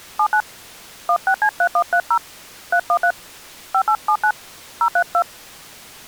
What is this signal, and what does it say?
DTMF, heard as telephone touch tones, dialled by hand, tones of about 70 ms. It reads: 79 16C3130 313 5879 032